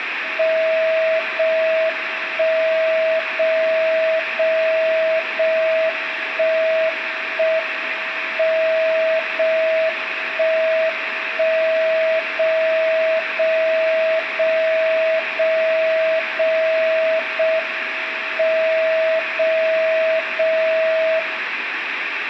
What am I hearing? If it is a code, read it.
Radio time signal (JJY), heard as a tone whose level steps once a second, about 640 Hz, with radio static and room echo. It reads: 0 1 0 0 0 1 1 M 0 1 1 0 0 0 0 0 0 M 0 0 0